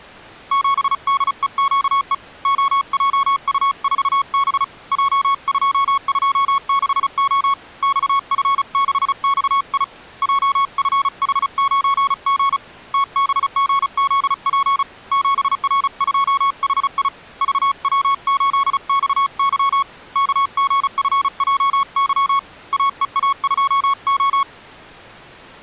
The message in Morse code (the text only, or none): 7DEQE OJU4B J226O XF6XI JFH9G TBGZP 7R2HI VW8XY KGFJY AEA2O